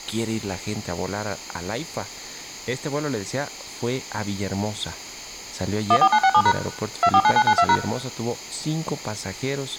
DTMF, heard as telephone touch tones, dialled by machine, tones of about 60 ms, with speech in Spanish. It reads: 14967# 249992#